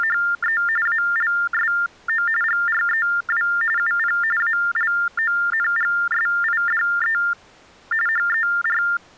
TTY/TDD text telephone tones (45.45 baud Baudot), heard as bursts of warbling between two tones, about 400 Hz shift, 1600 Hz centre. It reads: … ALSO GREW UP ALONGSIDE HER